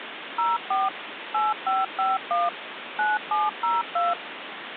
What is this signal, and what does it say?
DTMF, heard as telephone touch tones, dialled by machine, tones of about 180 ms, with phone line noise. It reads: 04 8551 9702